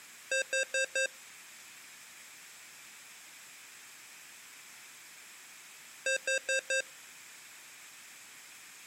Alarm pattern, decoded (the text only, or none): temporal four